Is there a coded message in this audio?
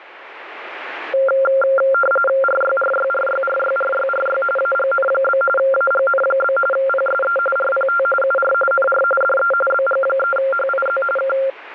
Yes: RTTY (45.45 baud, 850 Hz shift) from 1.1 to 11.5 s, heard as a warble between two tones, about 960 Hz centre, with radio static. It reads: RYRYRYRYRYRY AGN? AGN? PSE RPT UR NR DE BG3HIZ K